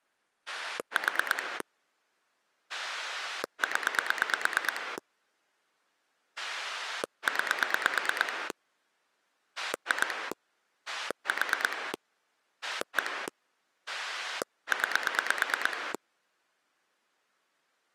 Pulse dialling, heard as a rotary dial, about 9 pulses a second. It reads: 4 0 9 2 4 1 9